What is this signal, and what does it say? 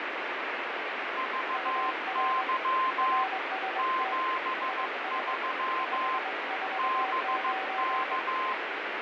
Morse code, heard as two keyed tones, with heavy radio static. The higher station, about 15 wpm, 1040 Hz: VY 73 BK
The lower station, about 22 wpm, 760 Hz: UR RST IS 549